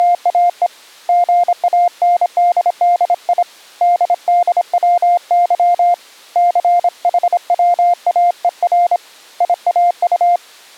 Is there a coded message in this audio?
Yes: Morse code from 0.0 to 10.4 s, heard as a keyed tone, hand-sent with a paddle, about 26 wpm, 700 Hz. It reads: … GANDDI DDWY CHWAER IAU